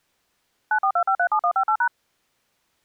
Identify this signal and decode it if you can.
DTMF, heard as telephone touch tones, dialled by machine, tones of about 80 ms. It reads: 942537158#